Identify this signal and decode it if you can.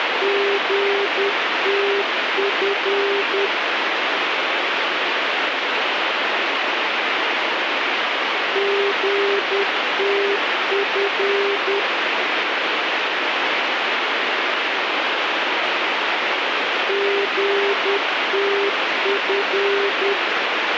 Morse code, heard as a keyed tone, machine-sent, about 10 wpm, 400 Hz, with heavy radio static. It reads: GTF GTF GTF